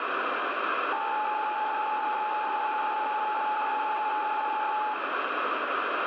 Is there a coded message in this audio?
Yes: PSK63 (62.5 baud) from 0.9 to 4.9 s, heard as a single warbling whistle, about 850 Hz, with radio static and room echo.